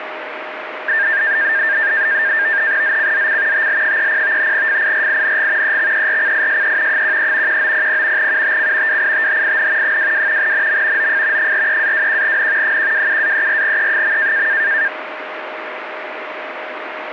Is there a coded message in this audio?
Yes: NAVTEX (SITOR-B), 100 baud, 170 Hz shift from 0.9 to 14.9 s, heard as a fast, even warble, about 1700 Hz centre, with radio static and a steady whistle near 620 Hz. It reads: ZCZC TL30 FIRING EXERCISE 13 1900 UTC WITHIN 22 NM OF 43-21N 127-34E.